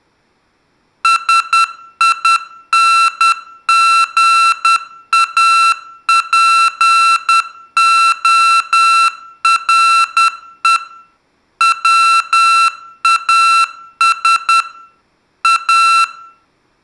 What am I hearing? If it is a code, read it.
Morse code, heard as electronic beeps, machine-sent, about 10 wpm, 1340 Hz, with room echo. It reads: SINGAPORE WAS A